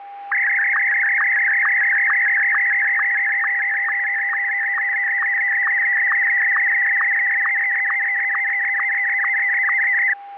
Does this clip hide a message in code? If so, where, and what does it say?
Yes: SSTV (slow-scan television), Martin M1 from 0.3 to 10.1 s, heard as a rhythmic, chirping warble, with a steady whistle near 800 Hz.